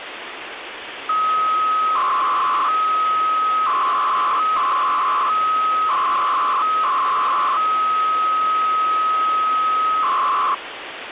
300-baud modem data (Bell 103 tones), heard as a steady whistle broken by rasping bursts, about 300 baud, 200 Hz shift, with phone line noise.